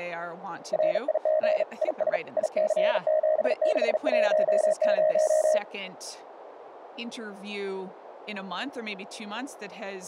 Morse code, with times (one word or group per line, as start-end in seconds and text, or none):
0.7-1.6 RIG
1.8-2.2 IS
2.4-5.6 IC7610